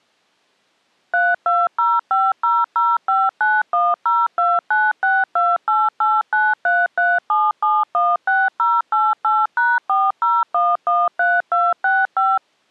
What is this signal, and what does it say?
DTMF, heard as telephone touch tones, dialled by machine, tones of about 210 ms. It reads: 32050059102962889337716088#40113265